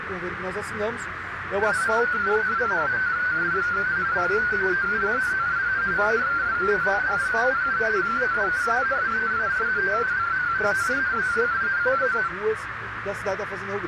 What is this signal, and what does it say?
Multi-tone FSK (Olivia or MFSK type), about 250 Hz wide, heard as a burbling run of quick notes, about 31.25 baud, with radio static and a narrow filter.